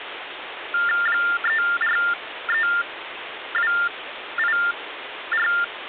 TTY/TDD text telephone tones (45.45 baud Baudot), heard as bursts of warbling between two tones, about 400 Hz shift, 1600 Hz centre, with phone line noise. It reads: 343284